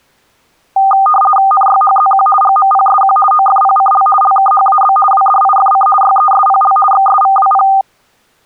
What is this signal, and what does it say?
RTTY (50 baud, 450 Hz shift), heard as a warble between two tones, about 1000 Hz centre. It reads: NYHZQ GMPSQ OFPCL LKHAB WDIFC YESPL XSVWP